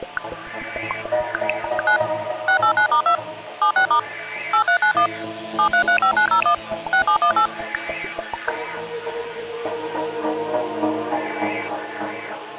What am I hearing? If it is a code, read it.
DTMF, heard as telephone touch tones, dialled by machine, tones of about 90 ms. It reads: 9 689*2 76* 8391 7335901 6718